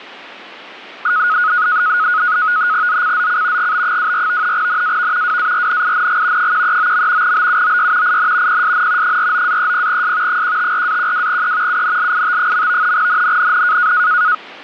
NAVTEX (SITOR-B), 100 baud, 170 Hz shift, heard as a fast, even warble, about 1360 Hz centre, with static crashes. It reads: ZCZC GB24 NAV WARNING 139. BUOY IN PSN 49-30S 154-12E UNLIT. NNNN